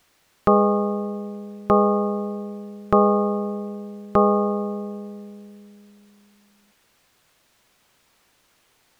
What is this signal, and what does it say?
Clock strike, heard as a bell. 4. Four o'clock.